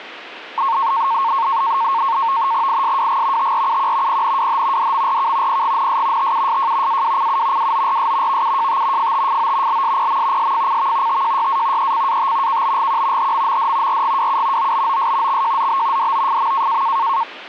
NAVTEX (SITOR-B), 100 baud, 170 Hz shift, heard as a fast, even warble, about 1000 Hz centre. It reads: ISWG TRUQ PNWH DMRK PGNS TUSJ AWCU WORS VUJT FTFO LSPM SFCV TJYA ECAT KBGQ HMMD RGWU OBOS XJZB DOFM